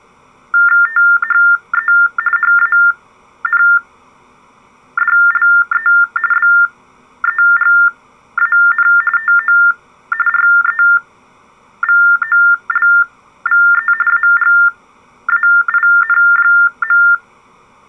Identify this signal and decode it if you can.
TTY/TDD text telephone tones (45.45 baud Baudot), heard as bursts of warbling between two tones, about 400 Hz shift, 1600 Hz centre. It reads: THE HANDLE BEGAN TO REVOLVE AGAIN.